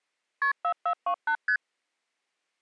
Multi-frequency trunk signalling (R1, as on North American trunks), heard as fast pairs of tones, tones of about 80 ms. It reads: KP 4428 ST